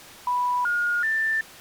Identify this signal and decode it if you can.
Telephone call progress tone (North American plan), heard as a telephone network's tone, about 980, 1430, 1800 Hz. Special information tone.